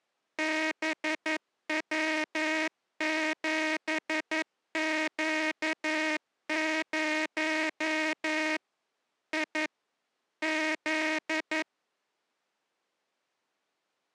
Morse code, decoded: BW7Q0 I Z

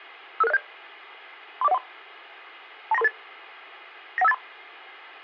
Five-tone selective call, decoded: 55607 34013 29338 91583

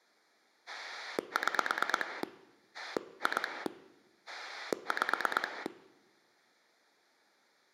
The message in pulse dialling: 6 2 5

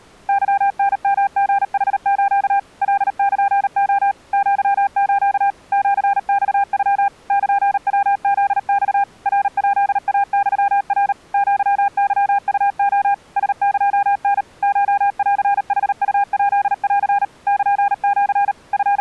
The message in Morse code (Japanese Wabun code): ケタヨリヌス カルレ アス シマノ ルヤフマ ナヱイユナ アケウレ ラエタ コンヌウヱン ルシ …

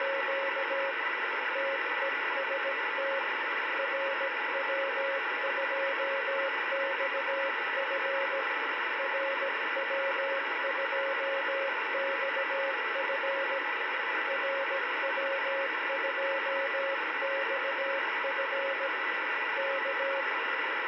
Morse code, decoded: … TEST RW2XF RW2XF RW2XF K

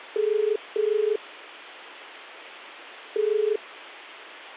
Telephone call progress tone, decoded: ringback tone

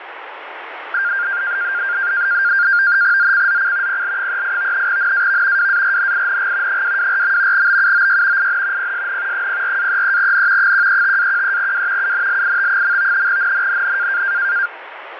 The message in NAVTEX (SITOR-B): ZCZC PL38 NAV WARNING 224. BUOY IN PSN 04-33N 135-13W UNLIT. NNNN

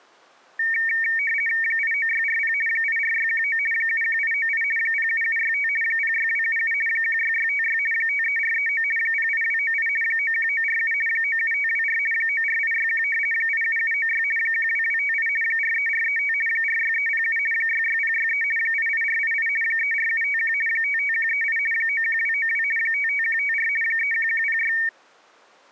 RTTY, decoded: 89640 84619 71898 07765 06277 16656 53439 08298 91947 97524 94861 87796 12258 43435 46307 66063 88488 34751 55138 91292 55154 31106

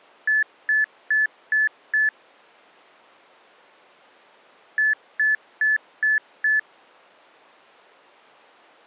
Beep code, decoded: 5 short

